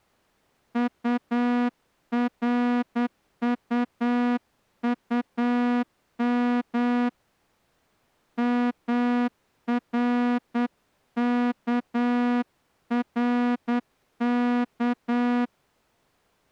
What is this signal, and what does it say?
Morse code, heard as a horn, hand-sent with a straight key, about 9 wpm. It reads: URUUM MRKRK